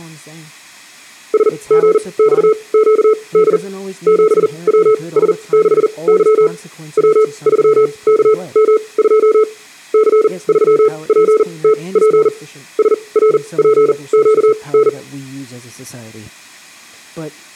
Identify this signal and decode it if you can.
Morse code, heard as a keyed tone, machine-sent, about 40 wpm, spaced as for 26 wpm, 430 Hz, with room echo and speech in English. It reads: SGXQD 7WS6Y W3KM2 C3PTP SRPQN